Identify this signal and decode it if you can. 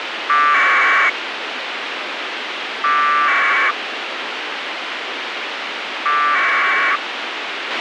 Packet radio (AX.25, as in APRS), 1200 baud, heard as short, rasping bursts, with radio hiss and a squelch burst at the end.